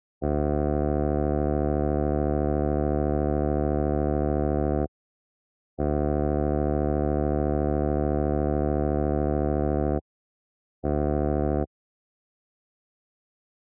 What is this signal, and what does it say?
Ship horn signal, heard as a ship's horn, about 70 Hz. 2 long, 1 short. At sea: I intend to overtake on your starboard side.